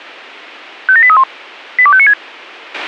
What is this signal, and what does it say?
Five-tone selective call (ZVEI), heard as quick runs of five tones, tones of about 70 ms, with a squelch burst at the end. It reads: 57831 82596